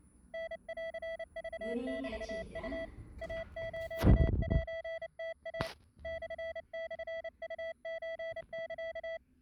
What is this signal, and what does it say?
Morse code (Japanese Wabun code), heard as a keyed tone, hand-sent with a paddle, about 29 wpm, 660 Hz, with the noise inside a lift. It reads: タンクメウ イスセムイ モモウソサ